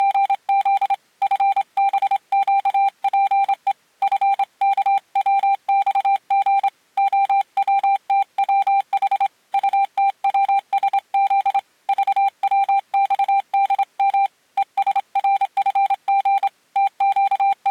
Morse code, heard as a keyed tone, hand-sent with a straight key, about 27 wpm, 790 Hz. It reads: … FBQPE FKWXG OWTWH UTWSZ VWXDM ESRFG …